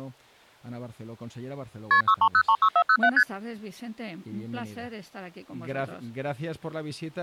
Multi-frequency trunk signalling (R1, as on North American trunks), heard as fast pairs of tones, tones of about 70 ms. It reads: KP 63036407 ST